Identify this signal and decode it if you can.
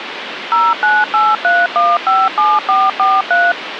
DTMF, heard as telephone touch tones, dialled by machine, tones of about 210 ms, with phone line noise. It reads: 0983157443